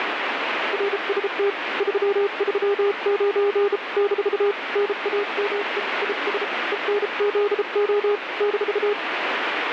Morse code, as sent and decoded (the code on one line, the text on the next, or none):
.-. ... - / ...-- ...-- ----. / -....- / -. .- -- . / .. ... / . -. --.. --- / -....-
RST 339 - NAME IS ENZO -